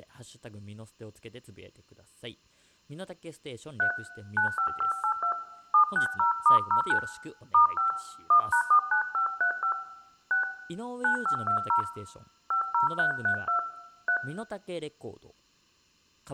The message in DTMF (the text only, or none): 3 95582 760*09 *5 1#49535 6 9520 50332 3